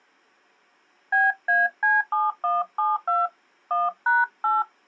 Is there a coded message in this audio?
Yes: DTMF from 1.1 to 4.6 s, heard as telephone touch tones, dialled by hand, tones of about 180 ms. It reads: BAC7172 1#8